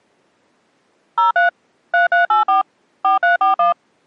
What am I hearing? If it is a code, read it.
DTMF, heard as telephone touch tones, dialled by machine, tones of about 130 ms. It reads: 03 3384 4341